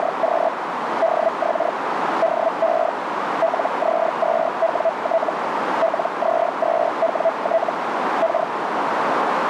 Hellschreiber (Feld-Hell, 122.5 baud), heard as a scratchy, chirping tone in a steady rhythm, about 660 Hz, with radio static and a narrow filter. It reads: … DX DE LZ2WT LZ2WT K